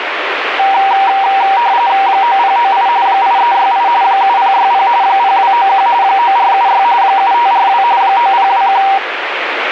RTTY (45.45 baud, 170 Hz shift), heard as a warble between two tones, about 870 Hz centre, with radio static. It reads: 9098 8368 7060 0291 9476 7542 9021